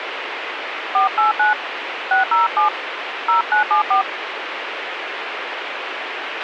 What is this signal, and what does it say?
DTMF, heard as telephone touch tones, dialled by hand, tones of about 130 ms, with radio hiss and a squelch burst at the end. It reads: 489 607 0974